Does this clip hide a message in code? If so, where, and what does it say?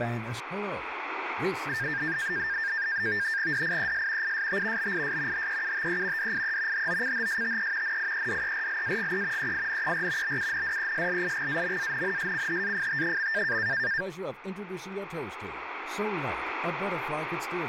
Yes: NAVTEX (SITOR-B), 100 baud, 170 Hz shift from 1.7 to 14.0 s, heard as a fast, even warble, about 1700 Hz centre, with radio static and speech in English. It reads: DIES IST BIS HEUTE DIE HOCHSTE NIEDERLAGE EINER BUNDESLIGAMANNSCHAFT.